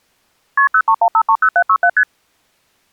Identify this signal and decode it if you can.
Multi-frequency trunk signalling (R1, as on North American trunks), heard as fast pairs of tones, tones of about 70 ms. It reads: KP 031530767 ST